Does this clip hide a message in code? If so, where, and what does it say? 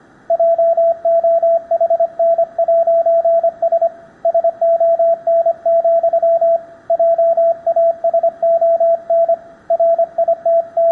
Yes: Morse code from 0.2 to 10.9 s, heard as a keyed tone, hand-sent with a paddle, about 25 wpm, 670 Hz, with room echo. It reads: JOHN'S SON, JASON …